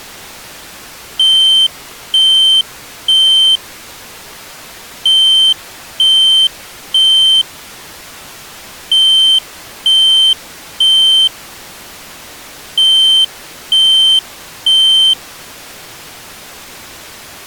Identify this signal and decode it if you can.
Alarm pattern, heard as an alarm's beeps, played four times, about 3100 Hz. Temporal three. Smoke or fire, evacuate.